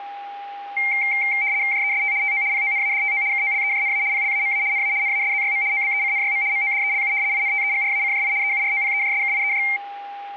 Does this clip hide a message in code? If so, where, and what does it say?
Yes: RTTY (75 baud, 170 Hz shift) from 0.8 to 9.8 s, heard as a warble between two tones, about 2200 Hz centre, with a steady whistle near 810 Hz. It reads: JEST TO PONADTO KOLEJNA PLAMA NA NASZYM OBECNYM MODELU INTEGRACJI EUROPEJSKIEJ